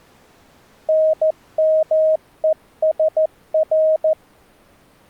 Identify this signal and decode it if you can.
Morse code (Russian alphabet), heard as a keyed tone, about 14 wpm, 630 Hz. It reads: НМЕСР